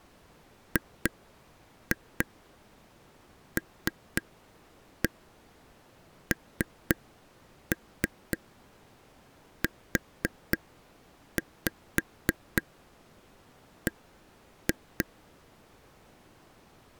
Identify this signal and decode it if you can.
Tap code, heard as taps on a table, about 3 knocks a second. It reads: GLNUB